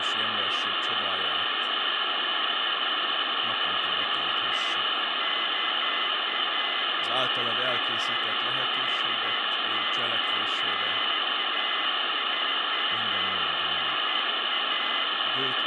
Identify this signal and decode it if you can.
Beeps of irregular length, with phone line noise, room echo and speech in Hungarian. There is no code.